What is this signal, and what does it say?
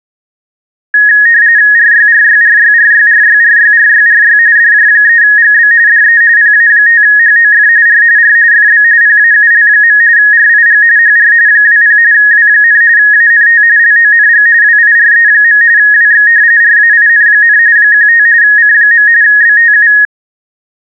RTTY (45.45 baud, 170 Hz shift), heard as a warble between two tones, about 1750 Hz centre. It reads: RYRYRYRYRYRYRYRY DJ3GB DE PA5HOF R R FB PAUL. RIG HR 20 W, ANT LONG WIRE. WX RAIN, 15 C. BTU